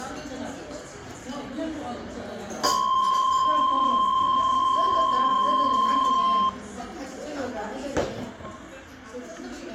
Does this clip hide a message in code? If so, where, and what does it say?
Yes: PSK63 (62.5 baud) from 2.6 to 6.5 s, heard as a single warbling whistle, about 1050 Hz, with the noise of a restaurant.